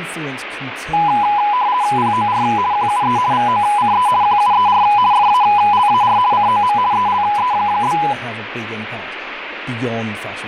RTTY (50 baud, 170 Hz shift), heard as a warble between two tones, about 910 Hz centre, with radio static and speech in English. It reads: POR QUE VOCE QUER FALAR COM ELE?